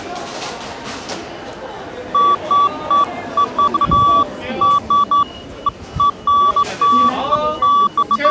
Beeps of irregular length, with the noise of a crowd indoors. There is no code.